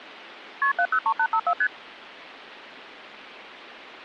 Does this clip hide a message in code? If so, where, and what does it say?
Yes: multi-frequency trunk signalling (R1, as on North American trunks) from 0.6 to 1.7 s, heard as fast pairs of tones, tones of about 70 ms. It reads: KP 703854 ST